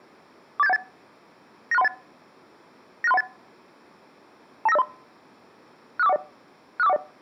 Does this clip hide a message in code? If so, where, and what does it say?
Yes: five-tone selective call (EIA) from 0.6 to 7.0 s, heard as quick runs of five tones, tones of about 30 ms. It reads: 48718 96318 96318 29503 65410 65410